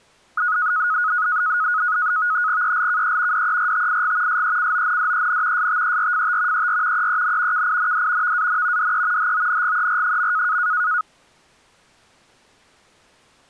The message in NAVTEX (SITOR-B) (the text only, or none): ELKE DERTIG SECONDEN STERFT ER EEN KIND VAN DE HONGER.